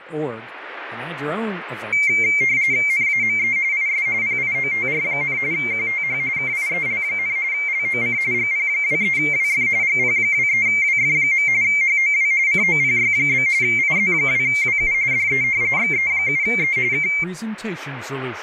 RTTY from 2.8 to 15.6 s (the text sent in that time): NAME IS PIOTR, QTH KIEL, LOC GP23WF GP23WF. HOW COPY? IZ2WU DE